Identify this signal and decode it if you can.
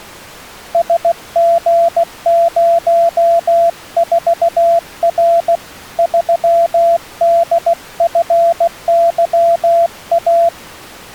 Morse code, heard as a keyed tone, hand-sent with a paddle, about 16 wpm, 680 Hz. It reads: SG04R 3DFYA